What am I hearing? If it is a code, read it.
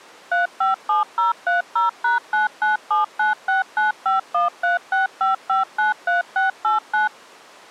DTMF, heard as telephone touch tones, dialled by machine, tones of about 140 ms. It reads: 357030#99796951365593689